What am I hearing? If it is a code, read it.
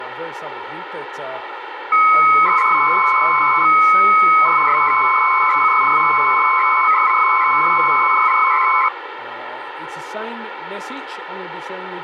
300-baud modem data (Bell 103 tones), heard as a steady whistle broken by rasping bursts, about 300 baud, 200 Hz shift, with phone line noise.